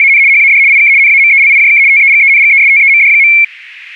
RTTY (75 baud, 170 Hz shift), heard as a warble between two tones, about 2250 Hz centre. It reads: … HAD IK NAMELIJK TEGENGESTEMD.